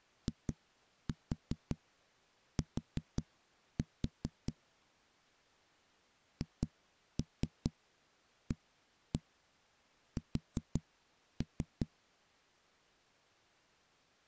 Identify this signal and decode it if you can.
Tap code, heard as knocks on a wall, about 5 knocks a second. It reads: IT HAS